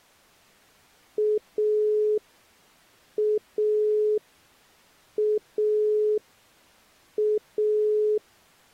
Telephone call progress tone (pulsed, as in Italy), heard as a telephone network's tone, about 420 Hz. Dial tone.